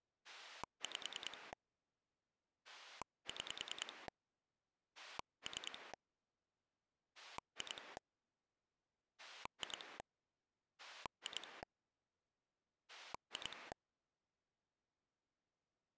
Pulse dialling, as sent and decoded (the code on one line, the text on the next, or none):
5 / 6 / 3 / 2 / 2 / 2 / 2
5 6 3 2 2 2 2